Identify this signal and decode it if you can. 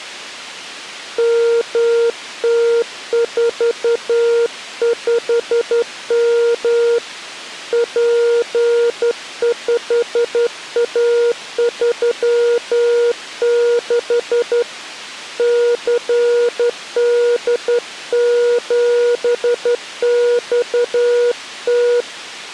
Morse code, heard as a keyed tone, hand-sent with a straight key, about 11 wpm, 470 Hz. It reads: MT45M P5A36 CD7XT